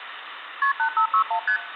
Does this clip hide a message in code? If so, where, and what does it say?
Yes: multi-frequency trunk signalling (R1, as on North American trunks) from 0.6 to 1.6 s, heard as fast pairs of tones, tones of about 90 ms, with phone line noise. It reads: KP 8561 ST